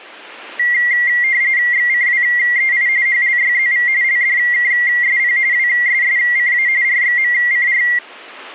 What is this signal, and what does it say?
RTTY (45.45 baud, 170 Hz shift), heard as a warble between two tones, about 2000 Hz centre. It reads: XCWEI HLYZV LDKSP WSSCA RXMCR